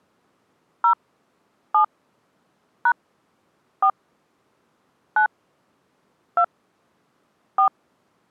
DTMF, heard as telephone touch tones, dialled by hand, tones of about 90 ms. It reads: 0 7 # 4 9 2 4